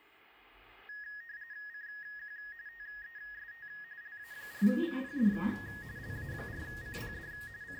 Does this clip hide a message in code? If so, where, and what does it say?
Yes: RTTY (45.45 baud, 170 Hz shift) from 0.9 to 7.8 s, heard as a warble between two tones, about 1750 Hz centre, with radio static and the noise inside a lift. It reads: CQ TEST LA4CPD LA4CPD …